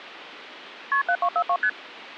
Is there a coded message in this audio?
Yes: multi-frequency trunk signalling (R1, as on North American trunks) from 0.9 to 1.7 s, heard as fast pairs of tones, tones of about 70 ms. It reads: KP 7242 ST